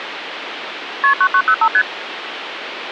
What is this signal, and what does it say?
Multi-frequency trunk signalling (R1, as on North American trunks), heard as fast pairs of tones, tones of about 70 ms, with phone line noise. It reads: KP 9905 ST